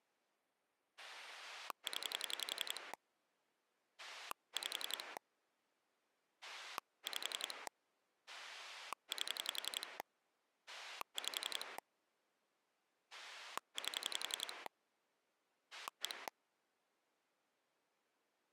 Pulse dialling, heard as a rotary dial, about 11 pulses a second. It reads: 0 5 5 8 5 8 1